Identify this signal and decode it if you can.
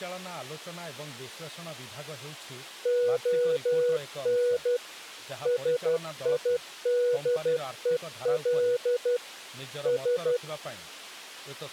Morse code (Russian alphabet), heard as a keyed tone, machine-sent, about 12 wpm, 490 Hz, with speech in Odia. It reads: ОН СИДЕЛ С